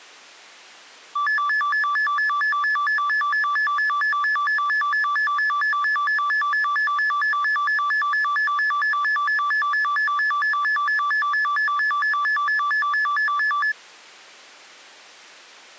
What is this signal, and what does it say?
A tone that alternates evenly between two pitches. There is no code.